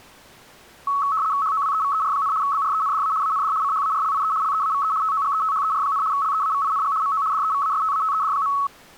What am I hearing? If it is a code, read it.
RTTY (75 baud, 170 Hz shift), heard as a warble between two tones, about 1200 Hz centre. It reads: HOWEVER, BRENDA AND CHARLIE LEAVE TOGETHER, LEAVING MO DEVASTATED.